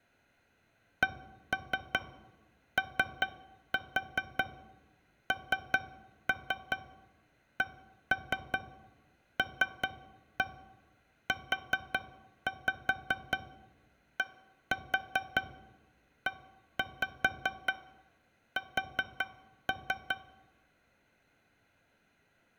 Tap code, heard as taps on a metal pipe, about 5 knocks a second. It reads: CONCLUDES